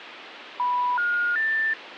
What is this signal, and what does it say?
Telephone call progress tone (North American plan), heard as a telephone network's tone, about 980, 1430, 1800 Hz, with phone line noise. Special information tone.